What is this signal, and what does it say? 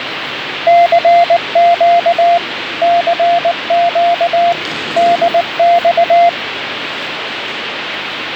Morse code, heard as a keyed tone, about 19 wpm, 690 Hz, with radio static and the noise of a subway station. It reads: CQ CQ DX